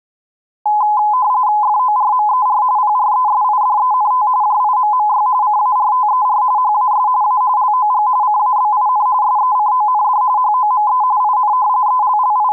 RTTY (45.45 baud, 170 Hz shift), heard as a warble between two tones, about 930 Hz centre. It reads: FORMER PRESIDENT JIMMY CARTER HAS A LOG CABIN SECOND HOME IN …